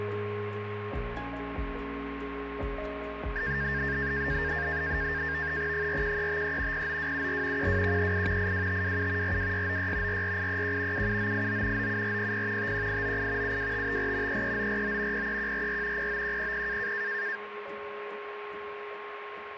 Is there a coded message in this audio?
Yes: NAVTEX (SITOR-B), 100 baud, 170 Hz shift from 3.4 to 17.4 s, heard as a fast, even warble, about 1700 Hz centre, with radio static and a steady whistle near 1080 Hz. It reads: 41353 09274 12138 82527 42696 44831 77989 97400 51898 72554 33949 03144 09100